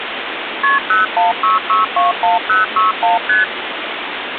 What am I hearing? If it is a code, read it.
Multi-frequency trunk signalling (R1, as on North American trunks), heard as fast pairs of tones, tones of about 150 ms, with phone line noise. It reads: KP 016621061 ST